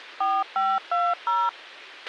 DTMF, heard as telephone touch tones, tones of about 220 ms, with a squelch burst at the end. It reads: 4520